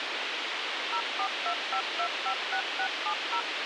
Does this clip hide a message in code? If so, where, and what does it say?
Yes: DTMF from 0.9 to 3.4 s, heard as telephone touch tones, dialled by machine, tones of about 80 ms, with radio hiss. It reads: 0425256670